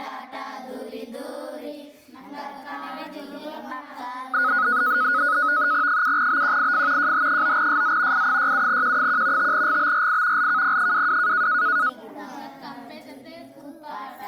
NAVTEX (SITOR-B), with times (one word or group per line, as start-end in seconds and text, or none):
5.9-7.1 7BQIF
7.0-8.3 JH9SZ
8.1-9.5 I67Q1
9.4-10.5 5GBRI
10.4-11.5 LKP22